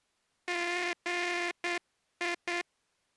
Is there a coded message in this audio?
Yes: Morse code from 0.4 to 2.7 s, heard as a buzzer, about 9 wpm. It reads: GI